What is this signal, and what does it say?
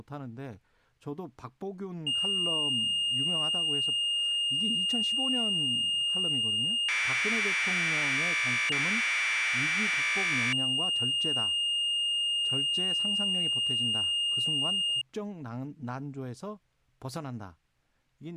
Commodore tape loading (standard loader), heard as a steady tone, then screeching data, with speech in Korean.